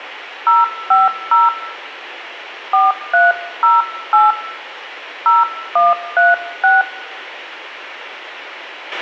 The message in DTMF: 050 4308 0136

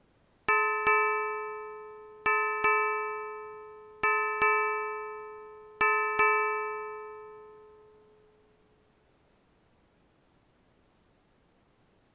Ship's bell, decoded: 8

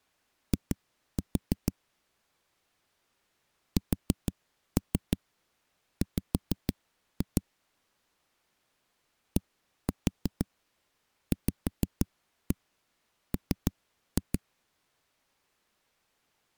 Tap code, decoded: I SW DVM

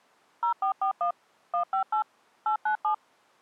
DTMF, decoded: 0441 158 897

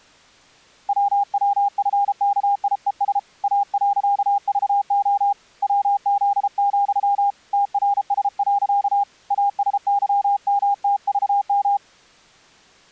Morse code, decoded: WWFKIES A.VO WZ, TRS. ASYMTVM

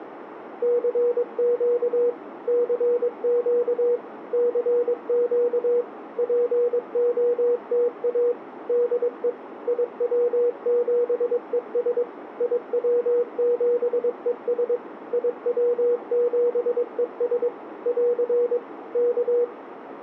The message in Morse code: CQ CQ CQ POTA DE IW7ES IW7ES IW7ES <AR> K

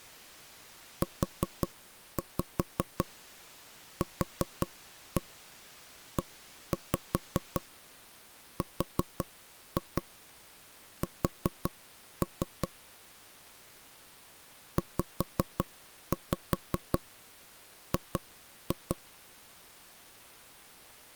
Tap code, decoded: UQERS ZG

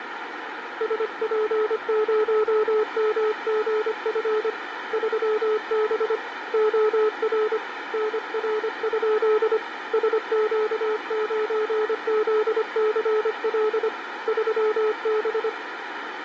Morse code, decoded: SP0MGF 3B OR NR? SQ9ZCL 3B

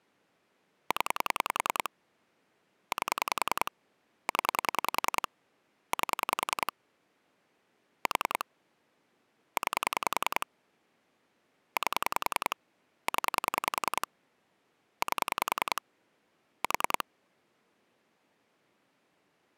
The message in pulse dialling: 0 8 0 8 4 9 8 0 8 4

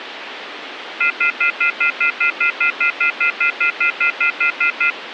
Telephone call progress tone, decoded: off-hook warning tone

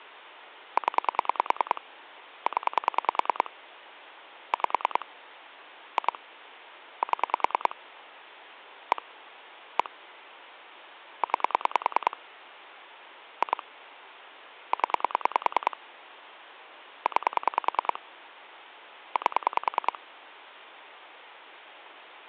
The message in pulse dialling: 0 0 5 2 7 1 1 9 2 0 9 8

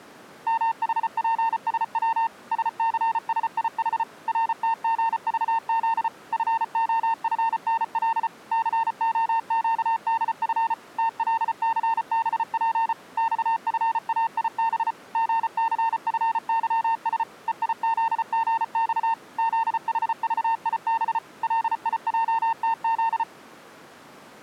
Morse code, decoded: MHPSW SCSIH RTGVZ FOFNL COQDF TLCBP XFAIB GCFYS EIZGX ZHVIB LIJTZ

